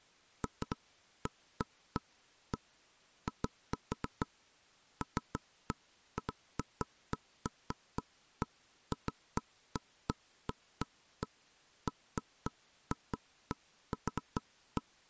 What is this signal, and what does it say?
Irregular knocks on wood. There is no code.